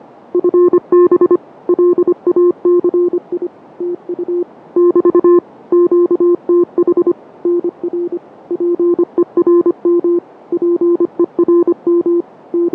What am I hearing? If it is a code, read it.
Morse code, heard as a keyed tone, machine-sent, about 25 wpm, 350 Hz, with radio static and fading. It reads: FB LACI TU <BT> QTH NR PERM PERM …